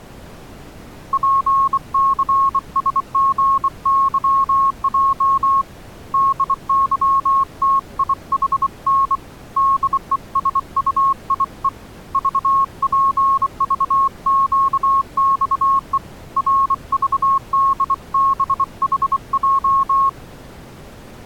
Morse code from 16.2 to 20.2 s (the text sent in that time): RVDBHJ